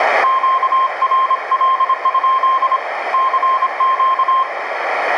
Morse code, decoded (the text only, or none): QRL? CQ